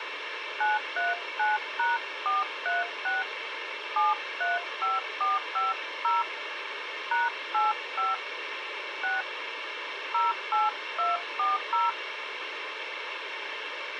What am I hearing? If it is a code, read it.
DTMF, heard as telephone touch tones, dialled by hand, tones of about 170 ms, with radio hiss. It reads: 939#436 735450 #85 6 08240